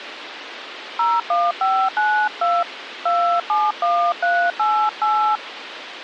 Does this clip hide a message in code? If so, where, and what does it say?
Yes: DTMF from 1.0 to 5.4 s, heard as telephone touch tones, dialled by hand, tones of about 300 ms, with radio hiss and a squelch burst at the end. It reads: 01592 271388